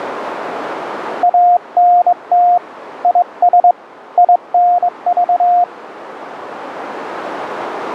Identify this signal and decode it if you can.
Morse code, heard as a keyed tone, hand-sent with a straight key, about 22 wpm, 710 Hz, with radio static. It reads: ANT IS INV